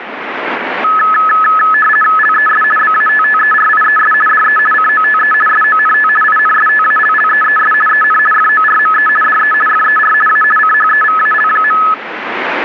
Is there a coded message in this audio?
Yes: RTTY (50 baud, 450 Hz shift) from 0.8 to 11.9 s, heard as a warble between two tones, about 1500 Hz centre, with radio static. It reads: LES BATTERIES DE COTE SONT INSTALLEES EN FORME DE FER A CHEVAL.